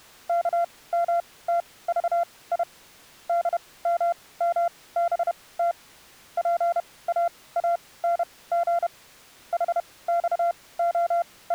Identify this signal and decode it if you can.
Morse code, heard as a keyed tone, machine-sent, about 31 wpm, spaced as for 20 wpm, 690 Hz. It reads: KMTVI DMMBT PAANG …